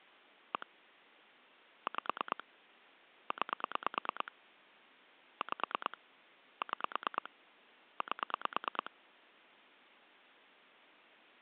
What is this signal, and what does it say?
Pulse dialling, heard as clicks on a phone line, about 9 pulses a second. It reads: 1 5 9 5 6 8